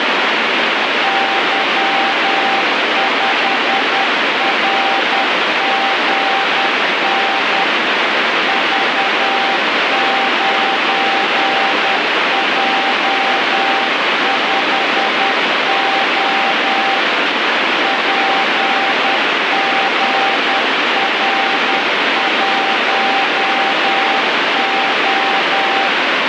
Morse code, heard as a keyed tone, machine-sent, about 10 wpm, 780 Hz, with heavy radio static. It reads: Y5RGN V9J5O PGR1O